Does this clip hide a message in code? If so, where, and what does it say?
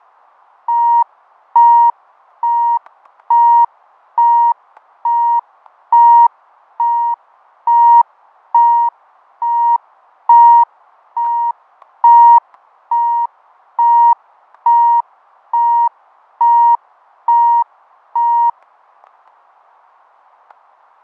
No, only evenly repeated beeps, with fading and static crashes.